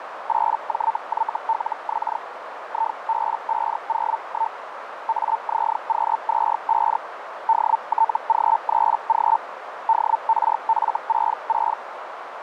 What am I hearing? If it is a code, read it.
Hellschreiber (Feld-Hell, 122.5 baud), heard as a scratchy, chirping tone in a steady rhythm, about 900 Hz, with radio static and a narrow filter. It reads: 8JYLX IB501 AZQ25 DTG3G DRF66